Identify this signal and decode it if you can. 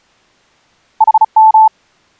Morse code, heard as a keyed tone, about 35 wpm, 880 Hz. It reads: HM